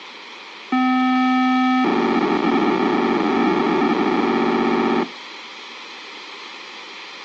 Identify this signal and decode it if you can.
POCSAG pager data (512 baud), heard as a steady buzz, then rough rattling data, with radio hiss and a squelch burst at the end.